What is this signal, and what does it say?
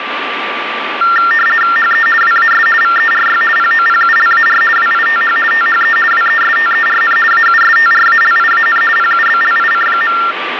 RTTY (50 baud, 450 Hz shift), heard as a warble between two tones, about 1600 Hz centre, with radio static and a steady whistle near 1170 Hz. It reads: HE WAS VERY POPULAR WITH THE WESTERN AUSTRALIAN PUBLIC.